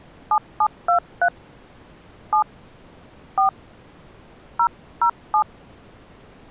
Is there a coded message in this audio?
Yes: DTMF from 0.3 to 5.4 s, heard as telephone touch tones, dialled by hand, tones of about 80 ms. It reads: 7723 7 4 007